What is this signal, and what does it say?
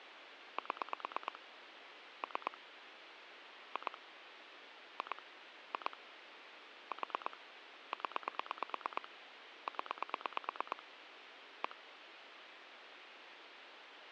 Pulse dialling, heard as clicks on a phone line, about 9 pulses a second, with phone line noise. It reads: 7 3 2 2 2 4 0 0 1